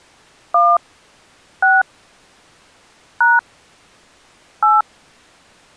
DTMF, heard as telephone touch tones, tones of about 180 ms. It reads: 1 6 # 8